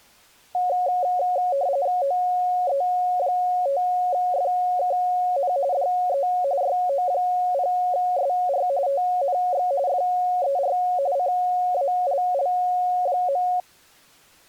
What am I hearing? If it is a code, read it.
RTTY (45.45 baud, 170 Hz shift), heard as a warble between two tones, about 640 Hz centre. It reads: OE5FKN DE YO0SR TNX FER CALL.